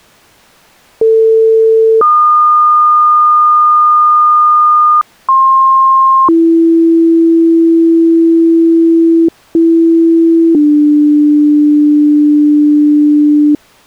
Two-tone page, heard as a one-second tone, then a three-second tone, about 450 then 1220 Hz, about 1060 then 330 Hz, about 330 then 300 Hz.